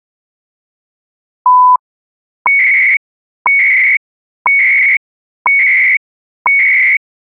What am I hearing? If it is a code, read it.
Radio time signal (CHU, Canada), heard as beeps and data bursts, one a second.